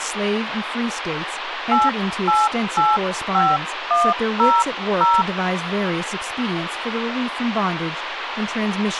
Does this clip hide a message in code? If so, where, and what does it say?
Yes: DTMF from 1.7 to 5.2 s, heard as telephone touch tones, dialled by hand, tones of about 220 ms, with phone line noise and speech in English. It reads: 8885100